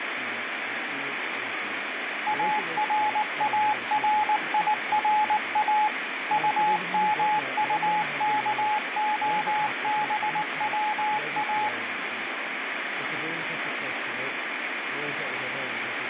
Morse code, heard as a keyed tone, machine-sent, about 19 wpm, 850 Hz, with radio static and speech in English. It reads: ARARIRA UMUKOBWA